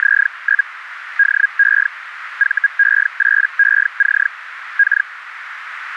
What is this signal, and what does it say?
Hellschreiber (Feld-Hell, 122.5 baud), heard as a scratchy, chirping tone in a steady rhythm, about 1650 Hz, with radio static and a narrow filter. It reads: … DE VE8EC K